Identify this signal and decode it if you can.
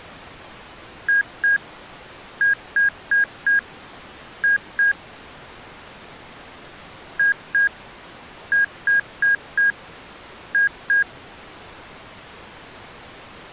Beep code, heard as beeps from a small speaker, played twice, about 1650 Hz. 2-4-2.